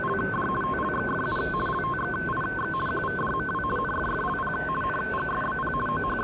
RTTY (50 baud, 450 Hz shift), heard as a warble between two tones, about 1290 Hz centre, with the noise of a subway station. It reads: … TLXFU LTXIX QVDMW NFFLP NGSBP …